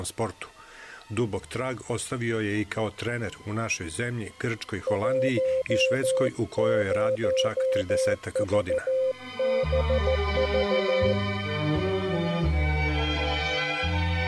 Morse code, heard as a keyed tone, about 14 wpm, 520 Hz. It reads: 10VBV